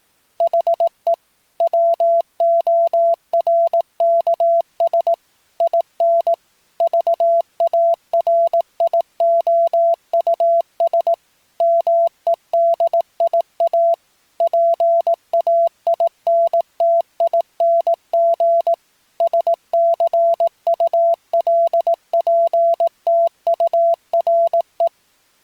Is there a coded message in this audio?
Yes: Morse code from 0.3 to 24.9 s, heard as a keyed tone, machine-sent, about 18 wpm, 680 Hz. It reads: HE WORKS IN VARIOUS MEDIA PAINTING SCULPTURE